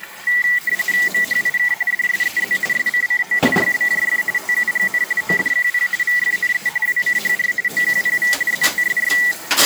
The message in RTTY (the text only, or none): MHIK DSEZ SCCO YBJF TUGN ODQP VFNE WCHR OQPV ZTSY